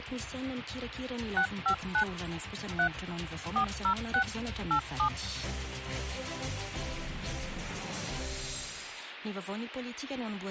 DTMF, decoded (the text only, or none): 659 3 406 87